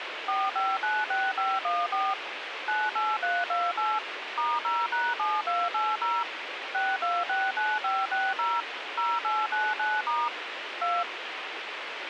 DTMF, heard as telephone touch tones, dialled by machine, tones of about 220 ms, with radio hiss. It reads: 4596514 98328 *0#7280 6269560 0899* 2